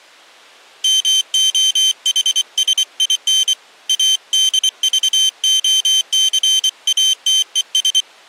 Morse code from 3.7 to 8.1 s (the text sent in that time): ADVOCATES